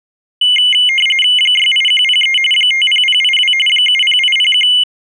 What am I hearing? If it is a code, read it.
RTTY (45.45 baud, 850 Hz shift), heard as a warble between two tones, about 2550 Hz centre. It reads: 68103 50082 70801